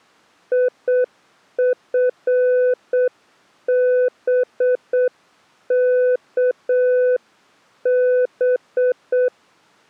Morse code, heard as a keyed tone, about 7 wpm, 500 Hz. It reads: IFBKB